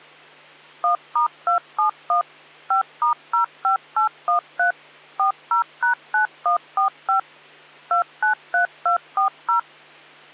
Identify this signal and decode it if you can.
DTMF, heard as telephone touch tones, dialled by machine, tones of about 110 ms, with hum. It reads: 1*271 5*05813 40#9145 293240